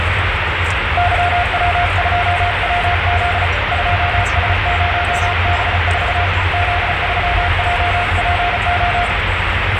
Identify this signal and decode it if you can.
Morse code, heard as a keyed tone, hand-sent with a paddle, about 35 wpm, 710 Hz, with radio static and the noise inside a car. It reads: YW2WZ 2S0B4 Z3JPO